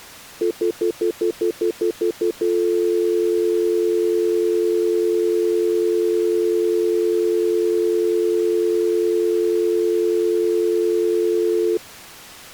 Telephone call progress tone (North American plan), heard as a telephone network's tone, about 350, 440 Hz, 0.1 s on and 0.1 s off. Stutter dial tone.